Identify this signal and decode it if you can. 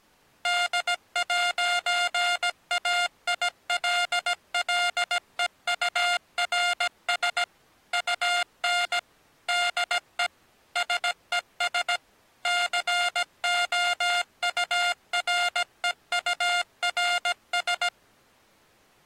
Morse code, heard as electronic beeps, machine-sent, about 17 wpm, 710 Hz. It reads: D'AILLEURS UN DE SES COUREURS